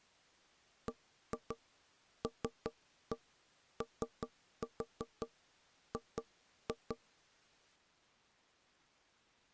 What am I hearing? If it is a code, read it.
Tap code, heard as knocks on wood, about 5 knocks a second. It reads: BLOG